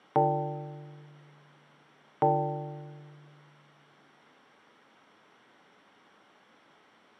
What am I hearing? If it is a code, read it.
Clock strike, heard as a bell, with room echo. 2. Two o'clock.